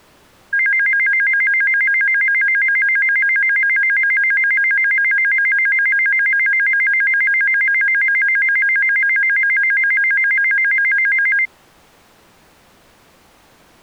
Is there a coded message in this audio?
No, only a tone that alternates evenly between two pitches.